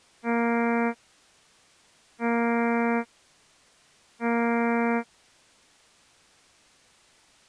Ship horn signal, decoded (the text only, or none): 3 short